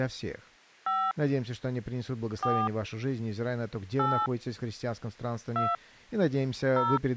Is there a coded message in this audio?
Yes: DTMF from 0.9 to 7.0 s, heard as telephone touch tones, dialled by hand, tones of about 210 ms. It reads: 5 4 8 2 0